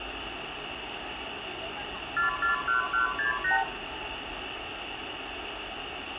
Multi-frequency trunk signalling (R2, with the far end's replies), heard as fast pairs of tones, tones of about 130 ms, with phone line noise, room echo and the noise of a residential street. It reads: 441168